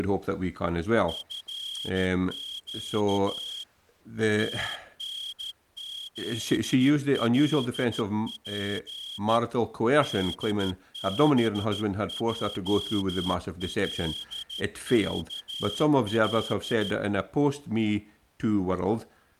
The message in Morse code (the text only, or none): FQ TNZLP DBJLKL